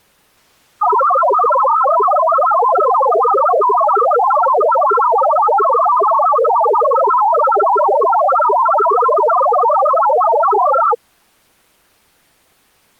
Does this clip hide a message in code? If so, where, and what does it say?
Yes: multi-tone FSK (Olivia or MFSK type), about 1000 Hz wide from 0.8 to 11.0 s, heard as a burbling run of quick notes, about 62.5 baud.